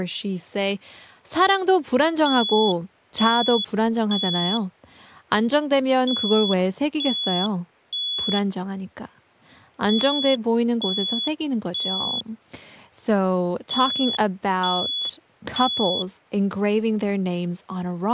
Alarm pattern, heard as an alarm's beeps, played four times, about 3400 Hz, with speech in English. Temporal three. Smoke or fire, evacuate.